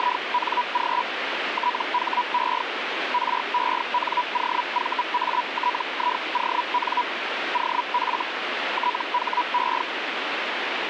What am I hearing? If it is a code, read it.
Hellschreiber (Feld-Hell, 122.5 baud), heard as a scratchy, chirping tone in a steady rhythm, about 980 Hz, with radio static. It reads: … THE RENOVATION OF THE